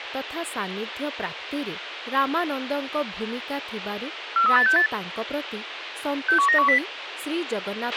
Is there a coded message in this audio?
Yes: five-tone selective call (CCIR) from 4.4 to 6.8 s, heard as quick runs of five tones, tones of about 100 ms, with radio hiss, a squelch burst at the end and speech in Odia. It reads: 43868 61910